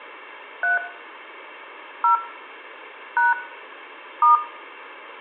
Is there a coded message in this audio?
Yes: DTMF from 0.6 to 4.4 s, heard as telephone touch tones, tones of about 150 ms, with room echo. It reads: 3 0 # *